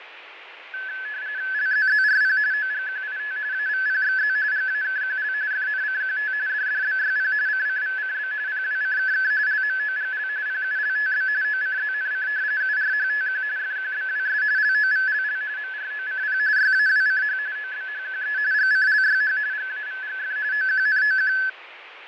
RTTY (45.45 baud, 170 Hz shift), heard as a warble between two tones, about 1600 Hz centre, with radio static and fading. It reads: LZZRP OGQIT AVPXZ GAKQL FNCQT DDBYP CCVCB PWCKK LMOGL PULTB OCZNC URHTQ FQBWS LOVLL MROCP YAWCH OBHQE GCLYH GAVGF OQNOQ